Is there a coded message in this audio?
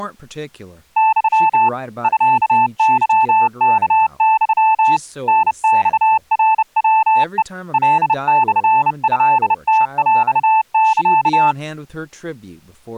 Yes: Morse code (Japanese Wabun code) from 0.9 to 11.6 s, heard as a keyed tone, hand-sent with a bug key, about 30 wpm, 880 Hz, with speech in English. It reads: ユ ミケワユ タマナヤヘ カモトムヰサ